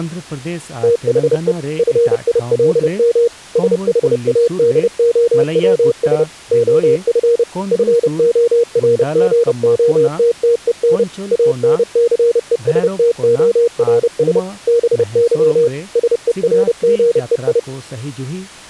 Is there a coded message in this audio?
Yes: Morse code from 0.8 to 17.7 s, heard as a keyed tone, machine-sent, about 30 wpm, 470 Hz, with speech in Santali. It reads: THE FILM SHADOWS OF FORGOTTEN ANCESTORS BY SERGEI